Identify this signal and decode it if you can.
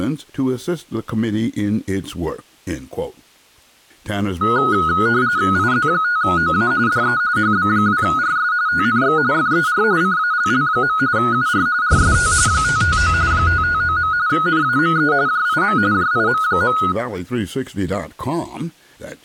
RTTY (45.45 baud, 170 Hz shift), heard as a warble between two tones, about 1360 Hz centre. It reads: IZ5OA DE HB2RS TNX FER CALL. UR RST 559 559. NAME JIM JIM.